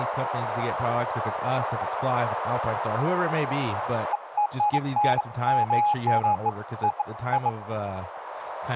Beeps of irregular length, with radio static and speech in English. There is no code.